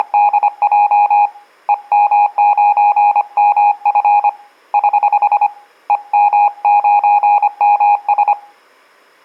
Morse code, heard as a keyed tone, hand-sent with a paddle, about 25 wpm, 830 Hz, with room echo. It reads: … EM9MF <HH> EM9MS